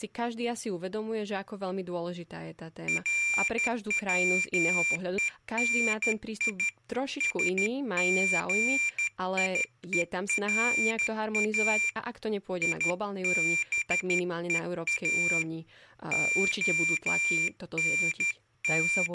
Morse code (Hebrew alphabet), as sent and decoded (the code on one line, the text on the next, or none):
.-. .-- . -. .. / ... --. .. . .-. .- / .. -... . .- / …
רצוני שגיורא יבוא …